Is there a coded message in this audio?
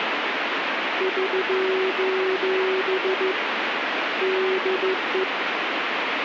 Yes: Morse code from 0.9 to 5.3 s, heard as a keyed tone, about 14 wpm, 380 Hz, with radio static. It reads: <SOS> DE